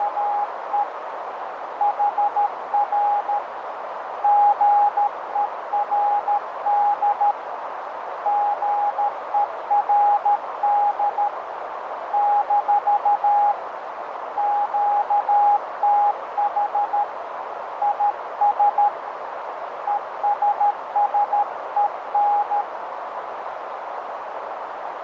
Morse code, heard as a keyed tone, hand-sent with a paddle, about 13 wpm, 820 Hz, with heavy radio static and a narrow filter. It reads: … HR GERD GERD - QTH IS ESSEN